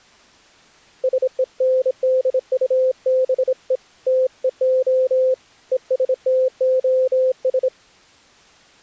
Morse code, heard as a keyed tone, hand-sent with a bug key, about 26 wpm, 520 Hz. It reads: SENDUBE TEO ESTOS